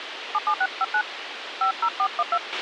DTMF, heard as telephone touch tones, dialled by hand, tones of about 70 ms, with radio hiss and a squelch burst at the end. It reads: 77659 50412